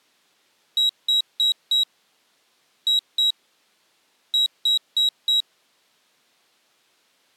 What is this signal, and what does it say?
Beep code, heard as a piezo beeper, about 3850 Hz. 4-2-4. In Phoenix BIOS tables: unexpected interrupt in protected mode.